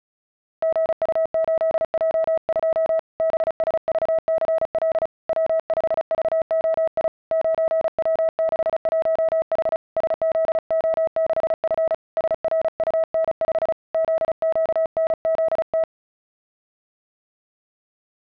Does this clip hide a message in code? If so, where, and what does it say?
Yes: Morse code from 0.6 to 15.9 s, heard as a keyed tone, hand-sent with a paddle, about 35 wpm, 650 Hz. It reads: GU8J2 BSVCL W5VOI 9W61H SZO6F SRUN5 ZQNZT